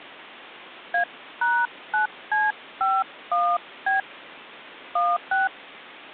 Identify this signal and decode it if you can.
DTMF, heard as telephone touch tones, dialled by hand, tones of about 180 ms. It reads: A#9C51B 16